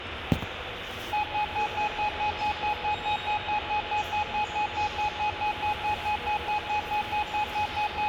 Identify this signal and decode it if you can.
Evenly repeated beeps, with phone line noise, room echo and the noise of a subway station. There is no code.